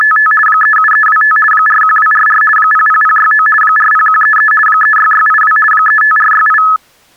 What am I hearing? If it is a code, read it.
RTTY (50 baud, 450 Hz shift), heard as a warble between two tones, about 1500 Hz centre. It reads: … 37325 41244 00069 40133 36682 35468